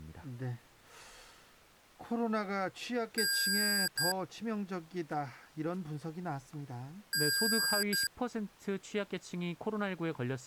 Beep code, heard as beeps from a small speaker, played twice, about 1600 Hz, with speech in Korean. 1 long, 1 short. In IBM BIOS tables: system board problem.